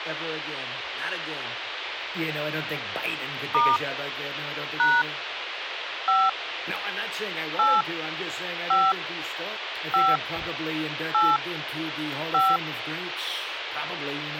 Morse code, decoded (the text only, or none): none